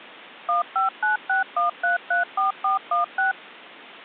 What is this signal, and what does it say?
DTMF, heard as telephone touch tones, dialled by machine, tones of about 140 ms. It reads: 15961334416